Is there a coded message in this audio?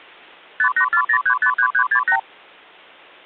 Yes: multi-frequency trunk signalling (R2, with the far end's replies) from 0.6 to 2.2 s, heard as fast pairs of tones, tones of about 80 ms. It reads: 5840353368